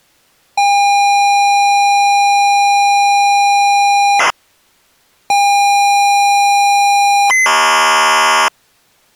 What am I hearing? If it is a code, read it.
ZX Spectrum tape loading, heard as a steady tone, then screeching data.